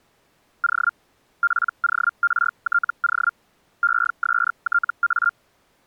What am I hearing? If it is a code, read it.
Hellschreiber (Feld-Hell, 122.5 baud), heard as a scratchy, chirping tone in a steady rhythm, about 1400 Hz. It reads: O PORTO ESTA